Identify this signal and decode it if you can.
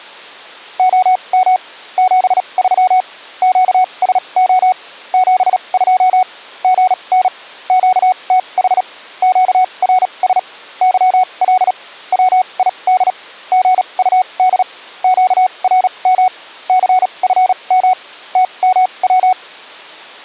Morse code, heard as a keyed tone, machine-sent, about 37 wpm, spaced as for 28 wpm, 740 Hz. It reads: OM 73 QSO 72 GN QTH QRS YL WID GUD QRM CFM TMW